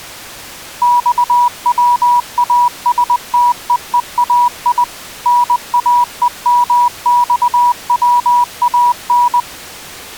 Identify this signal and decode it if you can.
Morse code (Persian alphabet), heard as a keyed tone, machine-sent, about 20 wpm, 970 Hz. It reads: خواستههای ناهمخوان